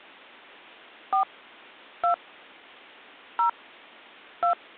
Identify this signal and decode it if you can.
DTMF, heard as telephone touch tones, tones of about 110 ms. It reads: 4 2 0 2